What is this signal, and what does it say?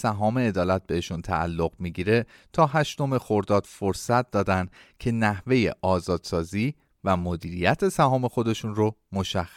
Speech in Persian. There is no code.